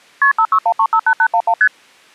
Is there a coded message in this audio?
Yes: multi-frequency trunk signalling (R1, as on North American trunks) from 0.2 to 1.7 s, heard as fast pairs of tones, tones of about 70 ms. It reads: KP 561358811 ST